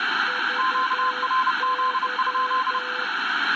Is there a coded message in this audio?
Yes: Morse code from 0.2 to 3.1 s, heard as two keyed tones, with radio static and room echo. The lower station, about 11 wpm, 500 Hz: VY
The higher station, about 30 wpm, 1040 Hz: QRZ?